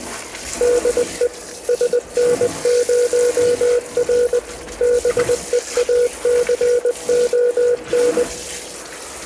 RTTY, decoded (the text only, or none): none